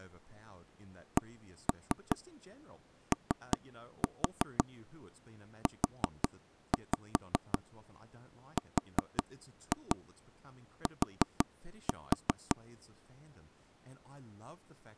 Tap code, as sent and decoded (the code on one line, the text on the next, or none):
1-3 3-4 4-5 4-2 4-4
COURT